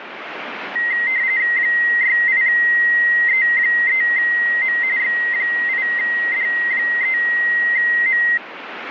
RTTY (45.45 baud, 170 Hz shift), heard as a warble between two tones, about 2000 Hz centre, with radio static. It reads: 68E3M X8D3M